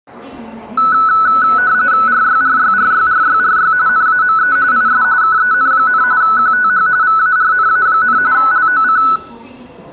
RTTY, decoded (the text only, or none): RYRYRYRYRY NAME IS KEN, QTH VARNA, LOC